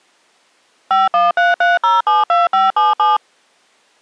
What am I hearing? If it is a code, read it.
DTMF, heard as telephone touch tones, dialled by machine, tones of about 170 ms. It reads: 5133072577